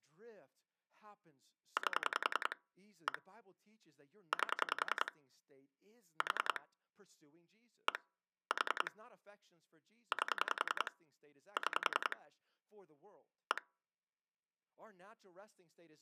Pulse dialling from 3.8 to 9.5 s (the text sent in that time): 8 4 1 4